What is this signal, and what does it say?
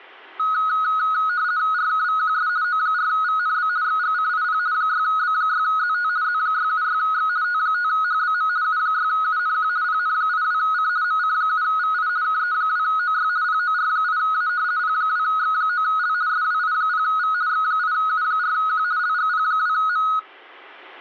RTTY (50 baud, 170 Hz shift), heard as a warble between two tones, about 1360 Hz centre. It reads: RKVQS O4VNB XGCIP 6B6ZT Z676X T5HBM U6UNQ PN82C MC7VI KE2OY POR8A P2X9L SWI0V X8U4Q LGP2M